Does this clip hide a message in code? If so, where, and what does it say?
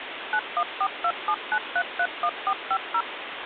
Yes: DTMF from 0.3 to 3.0 s, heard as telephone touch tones, dialled by machine, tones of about 60 ms, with phone line noise. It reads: 914279331450